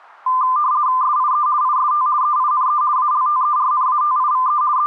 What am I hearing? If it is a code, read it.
RTTY (50 baud, 170 Hz shift), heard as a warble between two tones, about 1110 Hz centre. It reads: SIE IST EINE ALTERNATIVE …